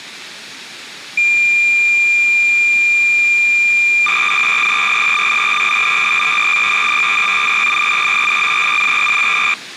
Cassette data (Kansas City type), 300 baud, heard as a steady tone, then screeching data.